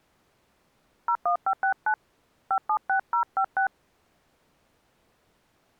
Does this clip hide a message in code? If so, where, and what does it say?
Yes: DTMF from 1.1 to 3.7 s, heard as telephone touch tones, dialled by hand, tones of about 80 ms. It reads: 01569 576056